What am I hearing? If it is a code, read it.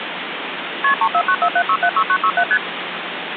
Multi-frequency trunk signalling (R1, as on North American trunks), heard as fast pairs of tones, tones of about 70 ms, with phone line noise. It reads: KP 34947676967 ST